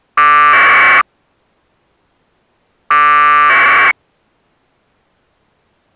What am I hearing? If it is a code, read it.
Packet radio (AX.25, as in APRS), 1200 baud, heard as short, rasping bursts.